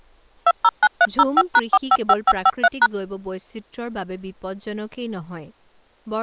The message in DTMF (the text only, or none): 209305#455553#